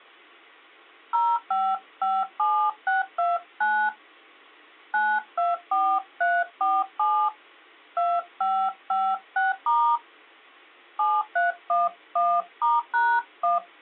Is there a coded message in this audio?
Yes: DTMF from 1.1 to 13.6 s, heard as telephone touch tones, dialled by hand, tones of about 230 ms. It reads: 0557629 924347 2556* 7311*#1